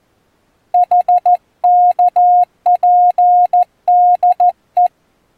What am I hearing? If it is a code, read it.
Morse code, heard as a keyed tone, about 14 wpm, 720 Hz. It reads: HKPDE